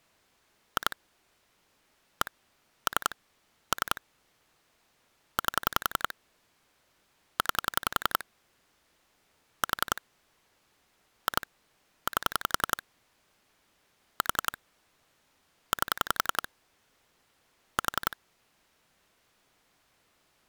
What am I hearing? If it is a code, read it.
Pulse dialling, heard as clicks on a phone line, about 11 pulses a second. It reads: 2 1 3 3 8 9 4 2 8 4 8 4